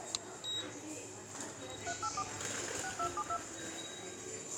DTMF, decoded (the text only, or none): 384 6272